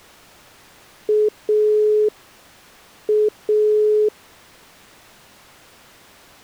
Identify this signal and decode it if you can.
Telephone call progress tone (pulsed, as in Italy), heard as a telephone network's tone, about 420 Hz. Dial tone.